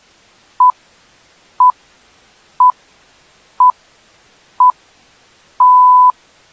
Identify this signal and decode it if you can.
Radio time signal (six pips, as the Greenwich Time Signal), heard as pips.